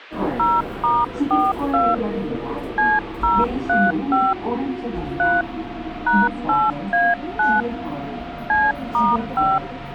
DTMF, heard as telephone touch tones, dialled by hand, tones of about 210 ms, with the noise inside a subway train. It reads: 0*42 C035 3 #8A9 C*5